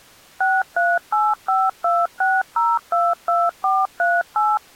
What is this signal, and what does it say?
DTMF, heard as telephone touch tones, dialled by machine, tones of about 210 ms. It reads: 638526022438